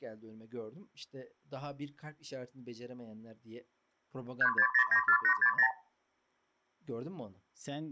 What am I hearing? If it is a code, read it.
Multi-frequency trunk signalling (R2, with the far end's replies), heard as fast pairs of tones, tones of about 80 ms, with speech in Turkish. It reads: 36094860